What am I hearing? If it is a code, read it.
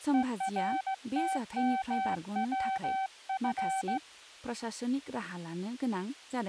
Morse code, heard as a keyed tone, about 16 wpm, 770 Hz, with speech in Bodo. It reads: ERTMWF